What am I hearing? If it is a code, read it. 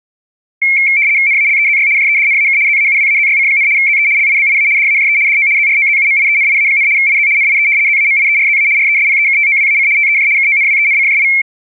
RTTY (75 baud, 170 Hz shift), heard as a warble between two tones, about 2250 Hz centre. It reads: NALEZY JEDNAK ZAUWAZYC, ZE LIBIA DAJE DO ZROZUMIENIA, IZ NIE ZAMIERZA RESPEKTOWAC TEJ KONWENCJI